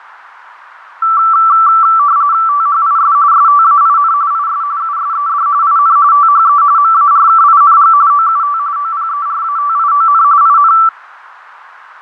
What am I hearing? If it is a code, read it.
RTTY (45.45 baud, 170 Hz shift), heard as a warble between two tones, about 1240 Hz centre, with radio static and fading. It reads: THIS STAIN IS USED IN THE MARKING OUT OPERATION IN